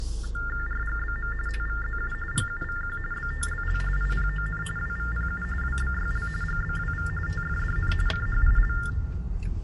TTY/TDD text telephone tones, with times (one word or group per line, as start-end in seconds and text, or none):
0.7-1.3 RGBM
1.5-2.1 TVZU
2.3-3.0 GUVQ
3.1-3.8 BTLL
4.0-4.6 IPON
4.8-5.4 WVPU
5.6-6.3 WBYL
6.4-7.1 GBWV
7.3-7.9 TFDN
8.1-8.7 CHIL